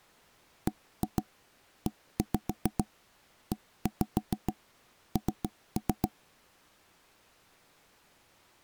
Tap code, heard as knocks on wood, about 7 knocks a second. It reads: BEEN